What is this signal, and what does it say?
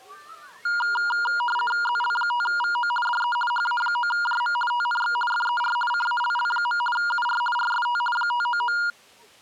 RTTY (50 baud, 450 Hz shift), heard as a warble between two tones, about 1190 Hz centre, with the noise of a park. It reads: ZL5VO DE HA9JM TNX FER CALL. UR RST 599